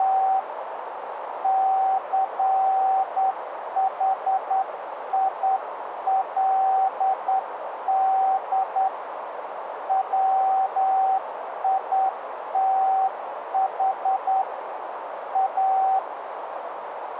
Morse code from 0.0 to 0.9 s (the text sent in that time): …